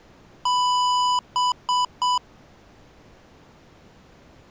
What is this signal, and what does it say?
Beep code, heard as beeps from a small speaker, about 990 Hz. 1 long, 3 short. In Award and IBM BIOS tables: video adapter failure; in AMI BIOS tables: memory failure.